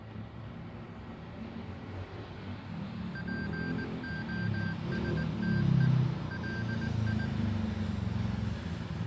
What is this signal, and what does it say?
Morse code, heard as electronic beeps, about 19 wpm, 1600 Hz, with the noise of a residential street. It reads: POSTE LI